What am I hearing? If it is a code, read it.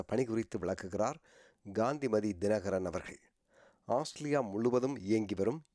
Speech in Tamil. There is no code.